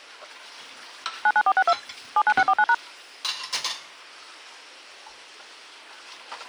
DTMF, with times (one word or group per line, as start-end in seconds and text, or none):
1.3-1.7 99462
2.2-2.7 79649#